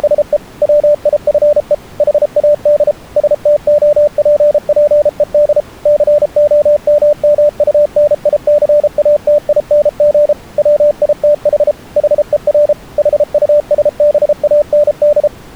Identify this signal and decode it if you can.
Morse code, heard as a keyed tone, machine-sent, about 33 wpm, 590 Hz. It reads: … WIFE HAD STOPPED COMMUNICATING WITH HER HUSBAND